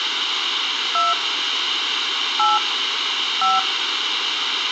DTMF, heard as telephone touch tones, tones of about 180 ms, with radio hiss. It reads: 2 8 5